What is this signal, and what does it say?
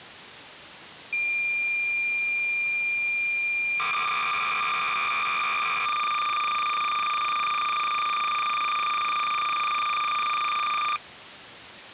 Cassette data (Kansas City type), 300 baud, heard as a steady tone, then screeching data.